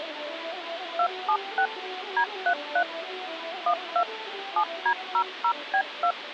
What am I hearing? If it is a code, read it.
DTMF, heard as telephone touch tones, dialled by machine, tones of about 80 ms, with phone line noise. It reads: 276 D33 12 7D00B2